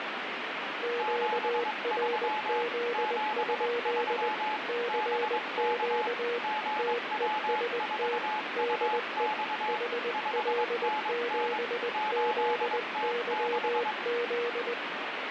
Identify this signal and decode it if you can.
Morse code, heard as two keyed tones, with radio static. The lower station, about 20 wpm, 480 Hz: QRZ? CQ TEST DE HL7ZYZ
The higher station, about 22 wpm, 860 Hz: 73 73 BK GW4UX 5NN 8T6